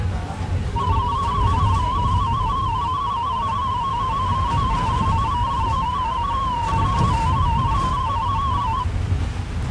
Multi-tone FSK (Olivia or MFSK type), about 250 Hz wide, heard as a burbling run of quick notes, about 31.25 baud, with the noise inside a bus.